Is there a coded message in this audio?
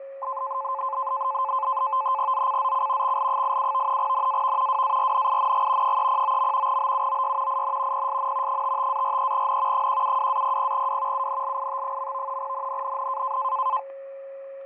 Yes: NAVTEX (SITOR-B), 100 baud, 170 Hz shift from 0.2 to 13.8 s, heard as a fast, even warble, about 950 Hz centre, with fading, static crashes and a steady whistle near 550 Hz. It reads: ZCZC XL87 NAV WARNING 309. BUOY IN PSN 55-43N 172-00W UNLIT. NNNN